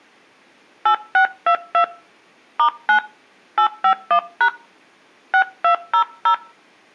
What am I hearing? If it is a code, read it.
DTMF, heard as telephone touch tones, dialled by hand, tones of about 90 ms. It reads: 8622 *9 851# 6200